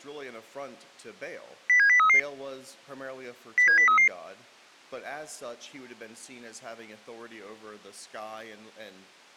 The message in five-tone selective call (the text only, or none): 07033 07033